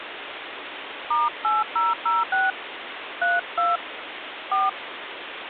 DTMF, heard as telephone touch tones, dialled by hand, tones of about 180 ms, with phone line noise. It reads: *8006 32 4